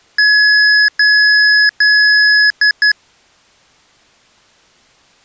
Beep code, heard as beeps from a small speaker, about 1700 Hz. 3 long, 2 short.